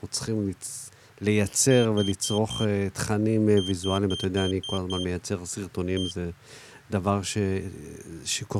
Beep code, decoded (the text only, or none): 4-6-1